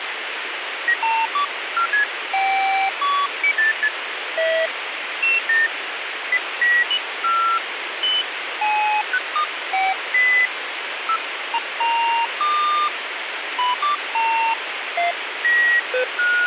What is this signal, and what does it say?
Electronic bleeps of random pitch and length, with radio hiss. There is no code.